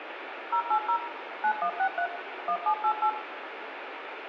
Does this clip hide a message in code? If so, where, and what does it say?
Yes: DTMF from 0.5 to 3.1 s, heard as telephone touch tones, dialled by machine, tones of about 80 ms, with radio hiss and room echo. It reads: 080 9163 1788